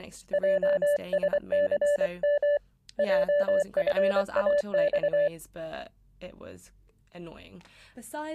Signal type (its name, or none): Morse code